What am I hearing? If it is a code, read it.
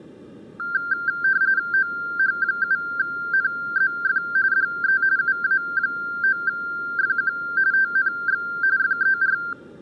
RTTY (45.45 baud, 170 Hz shift), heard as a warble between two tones, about 1480 Hz centre. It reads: OH7NZF DE UA9FQ TNX FER